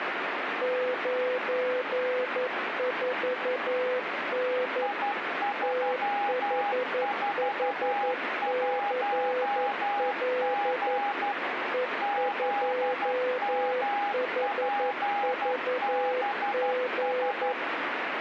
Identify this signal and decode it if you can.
Morse code, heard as two keyed tones, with radio static. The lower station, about 11 wpm, 500 Hz: 94N THHCL E2HVG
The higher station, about 12 wpm, 810 Hz: I341G ZMPBS